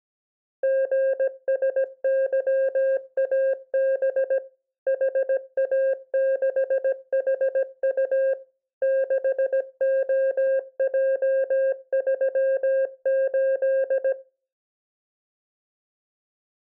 Morse code, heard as a keyed tone, machine-sent, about 17 wpm, 530 Hz. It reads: GSYAB HA6HU 6OJ38